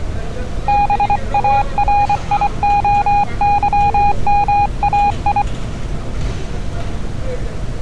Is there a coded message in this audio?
Yes: Morse code (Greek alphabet) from 0.6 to 5.5 s, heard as a keyed tone, hand-sent with a paddle, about 24 wpm, 820 Hz, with street noise. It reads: ΒΑΡΙΟΥΜΑΙ